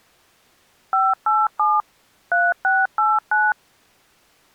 DTMF, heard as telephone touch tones, dialled by machine, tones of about 210 ms. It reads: 587 3689